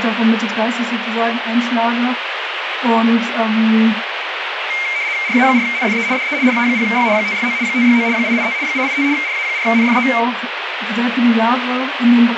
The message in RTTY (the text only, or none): RA4NFE DE RA0Y 569 569 885 885 RA4NFE